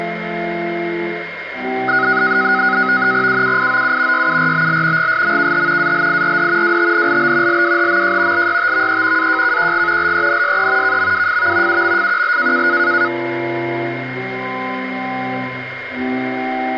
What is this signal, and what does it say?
NAVTEX (SITOR-B), 100 baud, 170 Hz shift, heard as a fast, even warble, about 1360 Hz centre, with radio static and a steady whistle near 2130 Hz. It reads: UUIOU YURBL GSMKH ALIRD WTNLB LWHMJ LYTVE AJKQG LENSE KMWFV UMFQL